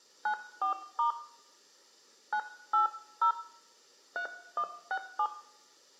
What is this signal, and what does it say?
DTMF, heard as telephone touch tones, dialled by hand, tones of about 100 ms, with room echo. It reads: 94* 980 3167